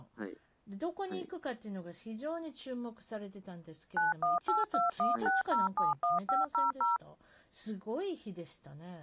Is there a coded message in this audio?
Yes: DTMF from 4.0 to 7.0 s, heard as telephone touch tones, dialled by machine, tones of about 160 ms, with speech in Japanese. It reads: 918216071500